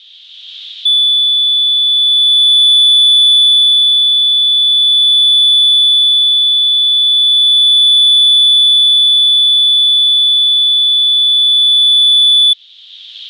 A steady tone. There is no code.